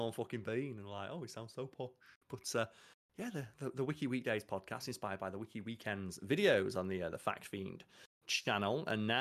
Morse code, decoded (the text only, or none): none